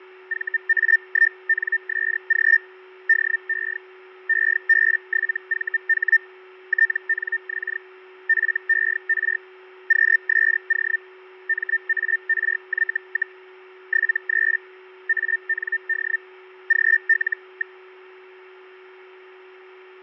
Hellschreiber (Feld-Hell, 122.5 baud), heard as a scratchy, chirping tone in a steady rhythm, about 1800 Hz, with fading and a steady whistle near 370 Hz. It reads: VA1NSG DE EB7VH TNX FER QSO MARY, 73 AND GL.